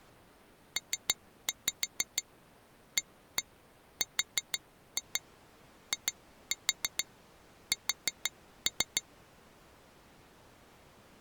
Tap code, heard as taps on glass, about 6 knocks a second. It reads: PARIS